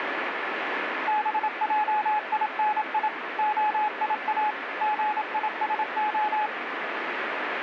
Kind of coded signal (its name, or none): Morse code